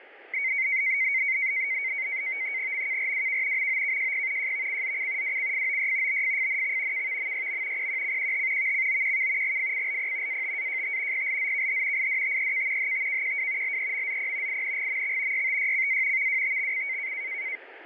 NAVTEX (SITOR-B), 100 baud, 170 Hz shift, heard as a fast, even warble, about 2150 Hz centre, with radio static. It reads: MKRWK MOKJP JVCZC WCFOY BFFNX KVMYM PQCQH VCOQK GFCLP ATAJT PLZKH IDTEK HTKQW LEMZP INGMX YTYCA VWTXC